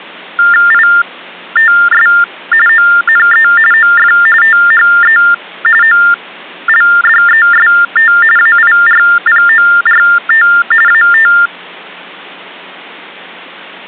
TTY/TDD text telephone tones (45.45 baud Baudot), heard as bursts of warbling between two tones, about 400 Hz shift, 1600 Hz centre. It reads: ITS ONE OF THE OLDEST AIRPORT AT